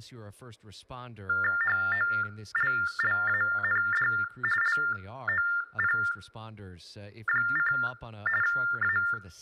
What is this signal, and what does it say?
TTY/TDD text telephone tones (45.45 baud Baudot), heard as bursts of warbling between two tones, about 400 Hz shift, 1600 Hz centre, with room echo and speech in English. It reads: HOLLAND LOP: A